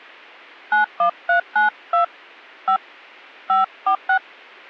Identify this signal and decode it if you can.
DTMF, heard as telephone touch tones, dialled by hand, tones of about 120 ms. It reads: 91392 5 546